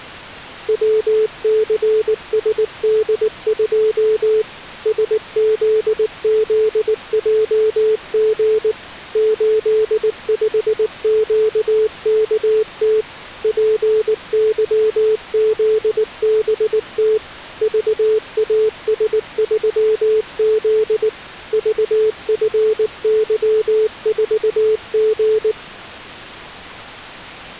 Morse code, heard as a keyed tone, machine-sent, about 19 wpm, 440 Hz. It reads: WCSD2 SZZJG 85QKT PYZBT VAS3Z VFY4G